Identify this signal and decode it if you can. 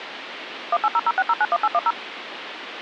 DTMF, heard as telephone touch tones, dialled by machine, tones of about 40 ms, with phone line noise. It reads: 18006091810